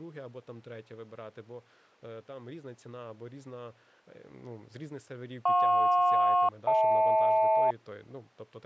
Aircraft SELCAL, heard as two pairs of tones, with speech in Ukrainian. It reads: JP-HL